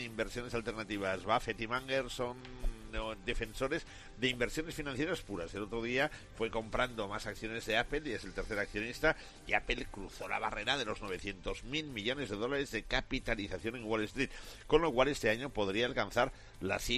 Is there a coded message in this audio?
No.